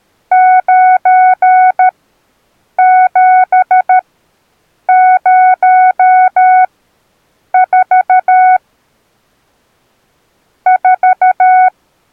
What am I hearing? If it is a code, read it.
Morse code, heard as a keyed tone, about 13 wpm, spaced as for 7 wpm, 740 Hz. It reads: 9704 4